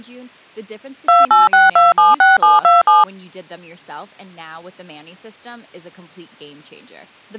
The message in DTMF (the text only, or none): 286276727